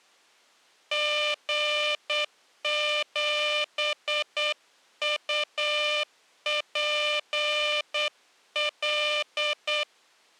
Morse code, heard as a buzzer, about 8 wpm. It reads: G7UPL